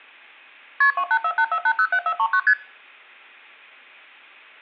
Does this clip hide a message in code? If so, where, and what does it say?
Yes: multi-frequency trunk signalling (R1, as on North American trunks) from 0.8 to 2.5 s, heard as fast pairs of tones, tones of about 70 ms, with room echo. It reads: KP 28484807439 ST